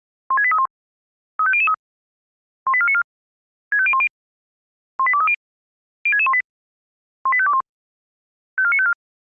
Five-tone selective call (ZVEI), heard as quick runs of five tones, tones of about 70 ms. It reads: 16831 35003 18494 65010 18230 06618 18521 54954